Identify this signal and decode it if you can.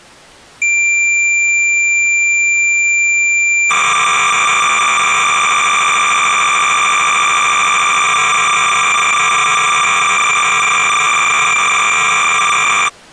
Cassette data (Kansas City type), 300 baud, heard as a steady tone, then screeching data.